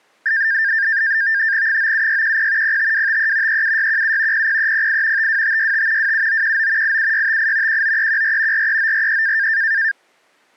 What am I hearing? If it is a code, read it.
NAVTEX (SITOR-B), 100 baud, 170 Hz shift, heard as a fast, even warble, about 1700 Hz centre. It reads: 97610 05253 37617 00308 52565 27919 87658 19314 43943